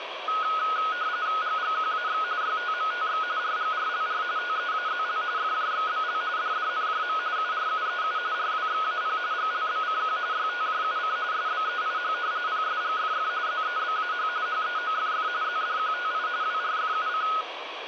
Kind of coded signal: RTTY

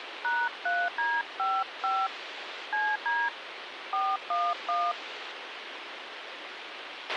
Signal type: DTMF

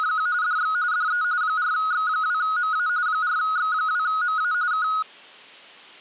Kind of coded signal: RTTY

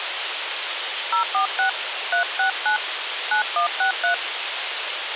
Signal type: DTMF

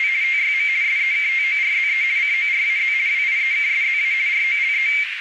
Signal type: RTTY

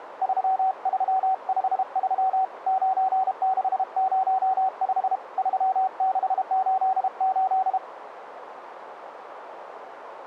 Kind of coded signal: Morse code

